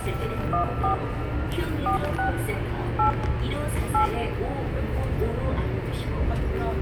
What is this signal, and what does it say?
DTMF, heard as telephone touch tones, dialled by hand, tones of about 110 ms, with radio hiss, room echo and the noise inside a subway train. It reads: 14 46 8 8